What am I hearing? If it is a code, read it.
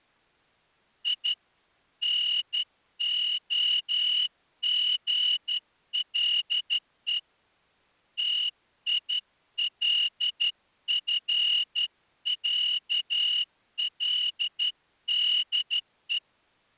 Morse code (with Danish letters), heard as a whistle, hand-sent with a straight key, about 12 wpm. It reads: I NOGLE TILFÆLDE